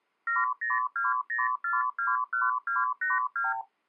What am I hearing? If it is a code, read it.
Multi-frequency trunk signalling (R2, with the far end's replies), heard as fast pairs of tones, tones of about 170 ms. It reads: 7020421282